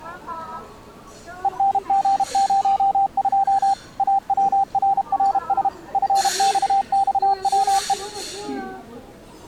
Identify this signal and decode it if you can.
Morse code, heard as a keyed tone, machine-sent, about 32 wpm, 790 Hz, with the noise of a restaurant. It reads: ENG02 AWRRS FXXWE